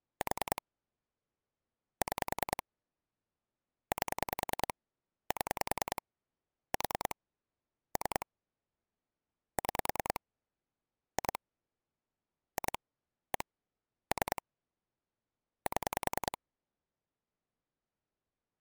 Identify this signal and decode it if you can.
Pulse dialling, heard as clicks on a phone line, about 10 pulses a second. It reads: 4 6 8 7 4 3 6 2 2 1 3 7